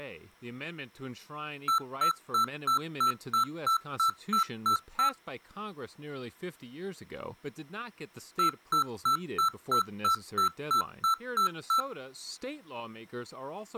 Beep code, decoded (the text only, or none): 11 short